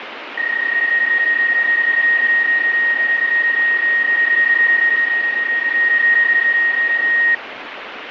PSK31 (31.25 baud), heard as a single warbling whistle, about 1850 Hz, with radio static.